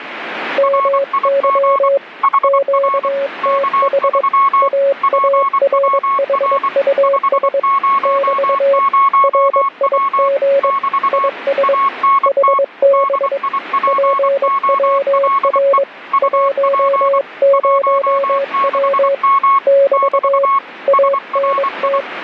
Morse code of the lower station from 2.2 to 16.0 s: QTH AARHUS <BT> RIG IS HB PWR

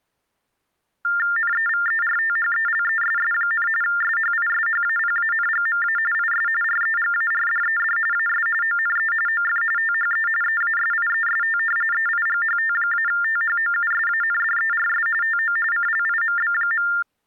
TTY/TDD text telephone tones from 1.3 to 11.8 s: NEVERTHELESS, SHISHAPANGMA IS REGARDED AS ONE OF THE EASIEST

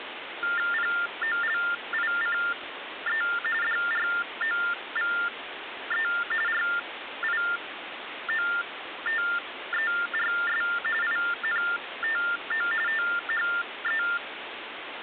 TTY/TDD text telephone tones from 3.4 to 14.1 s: DROVE RIOTERS INTO THE

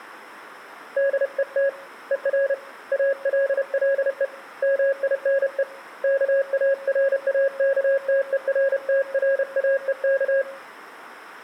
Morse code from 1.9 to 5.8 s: ER ALLE MINE

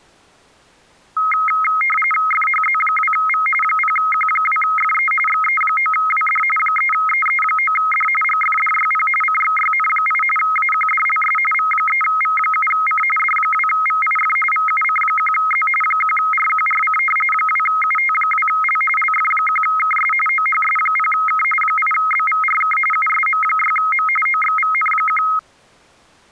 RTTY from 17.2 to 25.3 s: 2UT2L LF1KS OHS0K 8BVRK USM6M OXVN1

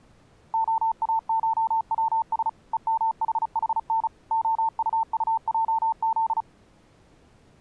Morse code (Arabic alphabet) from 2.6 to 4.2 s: ءمححن

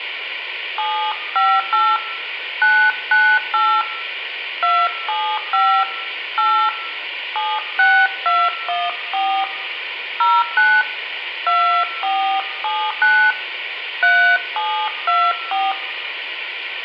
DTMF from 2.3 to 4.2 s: 998

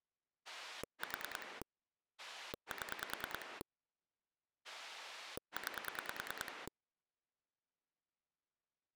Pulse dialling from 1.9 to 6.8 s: 7 9

